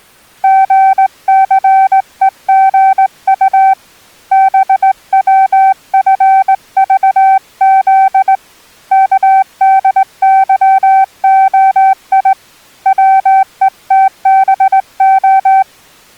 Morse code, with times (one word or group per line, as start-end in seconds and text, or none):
0.4-3.7 GCEGU
4.3-8.3 BWFVZ
8.9-12.3 KDYOI
12.9-15.6 WETBO